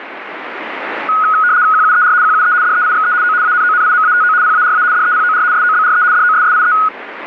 RTTY (75 baud, 170 Hz shift), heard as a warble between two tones, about 1360 Hz centre, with radio static. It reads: QUER QUE DEIXE O ANONIMATO PARA DEPOR SOBRE DOSSIE